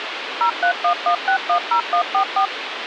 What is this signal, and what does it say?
DTMF, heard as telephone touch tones, dialled by machine, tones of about 90 ms, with radio hiss. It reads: 0311610144